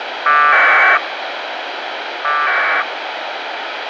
Packet radio (AX.25, as in APRS), 1200 baud, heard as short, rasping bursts, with radio hiss.